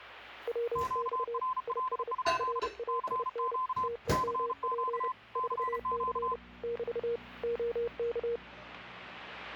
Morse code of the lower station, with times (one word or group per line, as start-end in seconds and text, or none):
0.5-1.4 WX
1.7-2.1 IS
2.4-3.6 RAIN
3.8-5.1 TEMP
5.4-6.4 4C
6.6-7.2 <BT>
7.4-8.4 OK